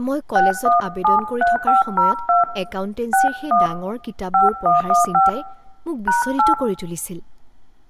DTMF, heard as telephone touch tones, dialled by hand, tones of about 150 ms, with room echo and speech in Assamese. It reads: 6173502 61 5115 #8